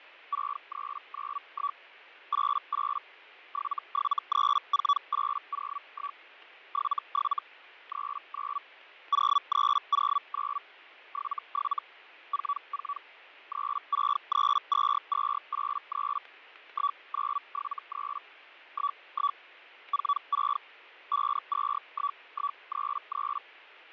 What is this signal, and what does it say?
Hellschreiber (Feld-Hell, 122.5 baud), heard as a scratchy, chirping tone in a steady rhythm, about 1140 Hz, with fading. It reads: 6391 88 7734801 77 39 0309 77 44 3632283 1973 11 46 521133